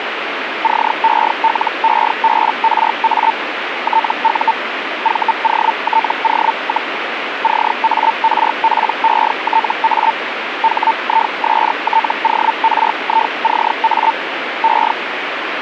Hellschreiber (Feld-Hell, 122.5 baud), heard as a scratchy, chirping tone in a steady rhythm, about 900 Hz, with radio static. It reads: CELEBRA TU VOTO, CARPETA HISTORICA E